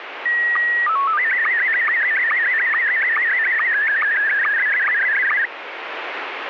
SSTV (slow-scan television), Scottie S1, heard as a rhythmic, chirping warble, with radio static.